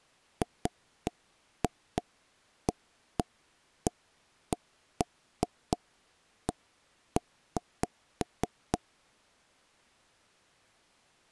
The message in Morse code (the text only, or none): none